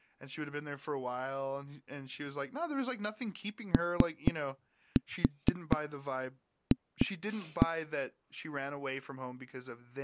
Tap code, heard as knocks on a wall, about 4 knocks a second, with speech in English. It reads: OF